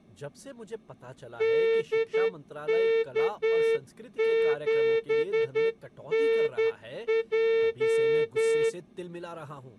Morse code, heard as a horn, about 10 wpm, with speech in Hindi. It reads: DK7NJ